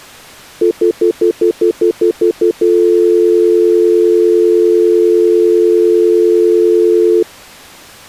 Telephone call progress tone (North American plan), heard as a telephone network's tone, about 350, 440 Hz, 0.1 s on and 0.1 s off. Stutter dial tone.